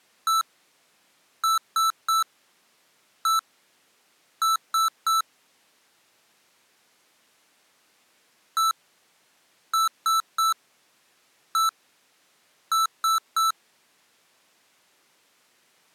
Beep code, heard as beeps from a small speaker, played twice, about 1320 Hz. 1-3-1-3. In Phoenix BIOS tables: keyboard controller test failure.